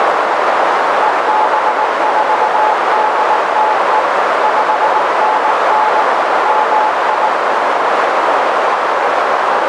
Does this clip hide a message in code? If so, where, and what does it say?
Yes: Morse code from 1.0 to 7.3 s, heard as a keyed tone, machine-sent, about 19 wpm, 860 Hz, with heavy radio static and a narrow filter. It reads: EB4DTE 5NN MI